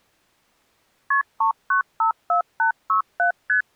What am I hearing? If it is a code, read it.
Multi-frequency trunk signalling (R1, as on North American trunks), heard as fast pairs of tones, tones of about 110 ms. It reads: KP 3954867 ST